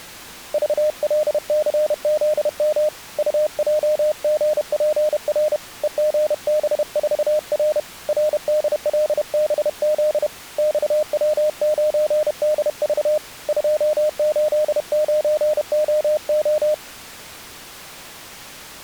Morse code, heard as a keyed tone, hand-sent with a paddle, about 31 wpm, 610 Hz. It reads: VLCZM UJGPR EGB4R RDLBZ XW9DV 289OO